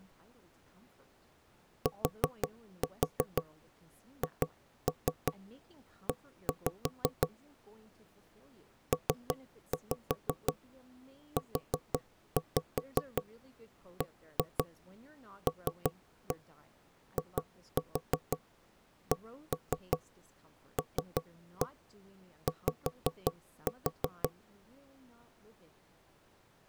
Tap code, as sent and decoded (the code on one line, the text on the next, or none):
4-4 2-3 1-5 / 3-5 4-5 1-2 3-1 2-4 1-3 3-1 5-4
THE PUBLICLY